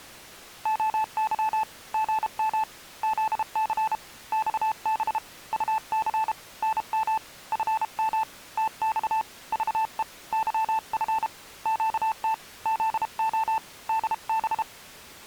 Morse code, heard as a keyed tone, hand-sent with a paddle, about 32 wpm, 880 Hz. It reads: OY GM ZC XB UC NM FM TX VE YF QT ZO DB